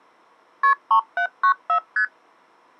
Multi-frequency trunk signalling (R1, as on North American trunks), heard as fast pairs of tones, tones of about 90 ms. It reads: KP 3794 ST